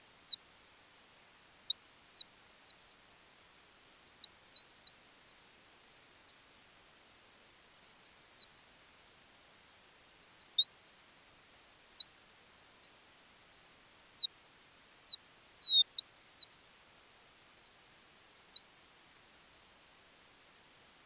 Bird-like chirps. There is no code.